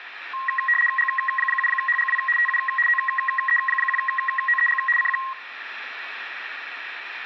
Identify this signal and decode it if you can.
RTTY (75 baud, 850 Hz shift), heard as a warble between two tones, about 1490 Hz centre, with radio static. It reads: G7HGW TU OE1OEG CQ